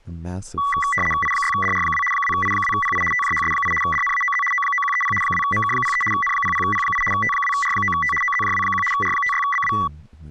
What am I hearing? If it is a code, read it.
RTTY (75 baud, 850 Hz shift), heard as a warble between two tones, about 1550 Hz centre, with speech in English. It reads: I6DR2 2I2PI TJHS8 DNAOZ O9130 2MK03 N00P8 T2R9T OZJW1 R56BW